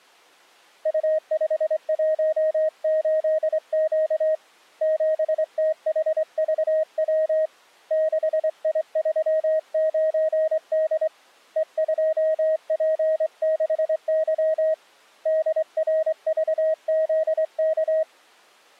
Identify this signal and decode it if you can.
Morse code, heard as a keyed tone, hand-sent with a straight key, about 24 wpm, 630 Hz. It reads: U518Q 7THVW 6I39D E2P6Y DRVZK